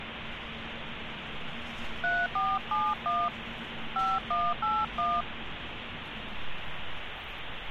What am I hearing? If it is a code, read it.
DTMF, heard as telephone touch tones, dialled by hand, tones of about 220 ms, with phone line noise and street noise. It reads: 3471 5181